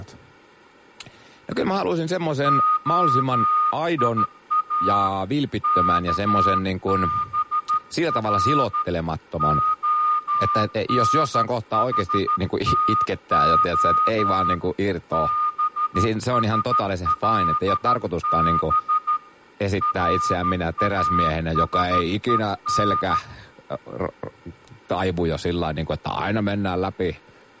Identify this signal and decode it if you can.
Morse code (Hebrew alphabet), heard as a whistle, hand-sent with a straight key, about 13 wpm, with room echo and speech in Finnish. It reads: היא כבר הנחתה בשלב ראשון